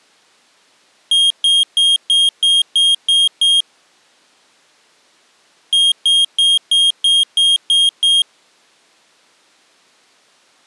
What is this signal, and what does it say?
Beep code, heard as a piezo beeper, played twice, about 3250 Hz. 8 short. In AMI BIOS tables: display memory failure; in Dell tables: LCD failure.